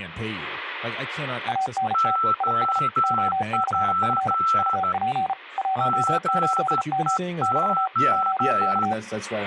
Morse code, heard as two keyed tones, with speech in English. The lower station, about 34 wpm, 760 Hz: ANT IS OCF UP 18M <BT> OK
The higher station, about 13 wpm, 1330 Hz: OP GEO